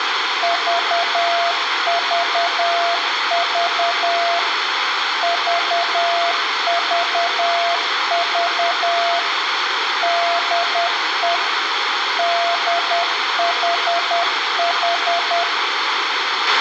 Morse code, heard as a keyed tone, machine-sent, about 10 wpm, 690 Hz, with radio hiss, a squelch burst at the end and room echo. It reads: VVV VVV DE DHH